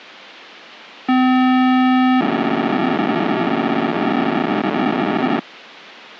POCSAG pager data (512 baud), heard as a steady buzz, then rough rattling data.